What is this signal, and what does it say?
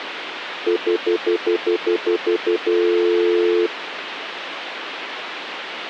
Telephone call progress tone (North American plan), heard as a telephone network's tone, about 350, 440 Hz, 0.1 s on and 0.1 s off, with phone line noise. Stutter dial tone.